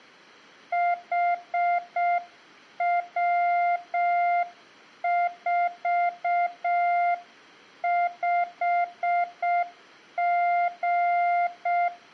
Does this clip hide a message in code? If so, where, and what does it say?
Yes: Morse code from 0.7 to 11.9 s, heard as a keyed tone, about 6 wpm, 700 Hz, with room echo. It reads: HW45G